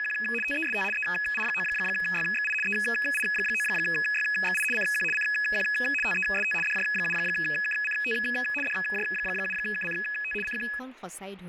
RTTY (75 baud, 850 Hz shift), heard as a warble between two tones, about 2100 Hz centre, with radio static and speech in Assamese. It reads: … TEST EI9YXI EI9YXI CQ CQ TEST DJ7KCT DJ7KCT CQ